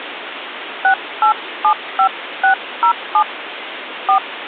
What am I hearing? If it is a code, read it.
DTMF, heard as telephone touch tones, dialled by hand, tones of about 100 ms, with phone line noise. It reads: 6875607 4